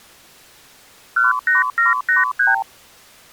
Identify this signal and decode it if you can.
Multi-frequency trunk signalling (R2, with the far end's replies), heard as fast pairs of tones, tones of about 150 ms. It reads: 18783